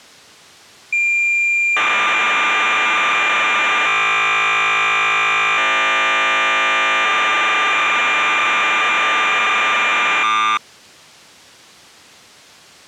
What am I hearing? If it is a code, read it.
Cassette data (Kansas City type), 1200 baud, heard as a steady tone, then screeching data.